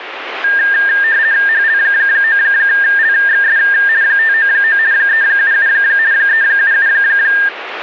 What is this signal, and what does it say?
RTTY (50 baud, 170 Hz shift), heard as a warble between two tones, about 1700 Hz centre, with radio static. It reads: HL9LXS 599 377 377